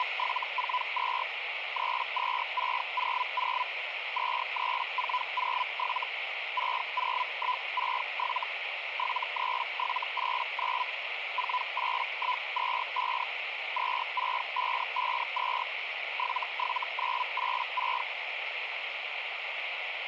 Hellschreiber (Feld-Hell, 122.5 baud), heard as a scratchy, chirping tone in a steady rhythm, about 1000 Hz, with radio static. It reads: … 32600 23407 60167 73789 48125 26552 77986